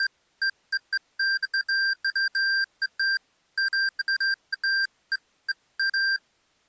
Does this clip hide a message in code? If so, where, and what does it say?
No, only beeps of irregular length.